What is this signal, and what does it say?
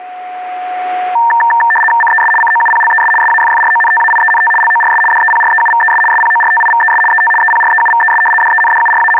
RTTY (75 baud, 850 Hz shift), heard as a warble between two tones, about 1360 Hz centre, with a steady whistle near 730 Hz. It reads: CES COUPLES SAFFRONTAIENT LORS DEPREUVES SPORTIVES ET EPREUVES …